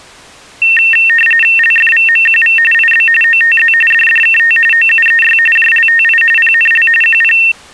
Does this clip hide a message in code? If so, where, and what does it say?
Yes: RTTY (45.45 baud, 850 Hz shift) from 0.6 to 7.5 s, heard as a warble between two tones, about 2250 Hz centre. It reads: LFVMQV IB OTZ DDKT OUEY JLTI PNL QP